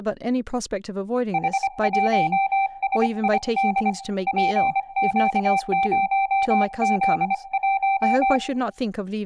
Morse code, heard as a keyed tone, hand-sent with a paddle, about 25 wpm, 780 Hz, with room echo and speech in English. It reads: H1SID PQ0Z1